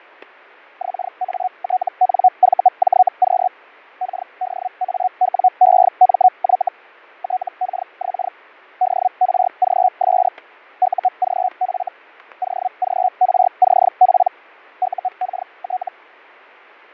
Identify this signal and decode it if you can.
Hellschreiber (Feld-Hell, 122.5 baud), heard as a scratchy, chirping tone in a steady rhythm, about 740 Hz, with fading and static crashes. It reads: XATNVJQ KDAWEMY TKX DRGS UGF OGRCP UKT